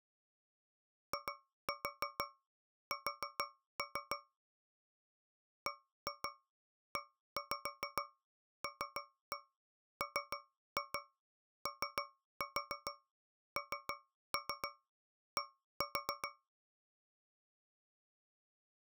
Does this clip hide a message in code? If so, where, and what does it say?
Yes: tap code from 1.1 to 16.5 s, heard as taps on a metal pipe, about 6 knocks a second. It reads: IS BELMOND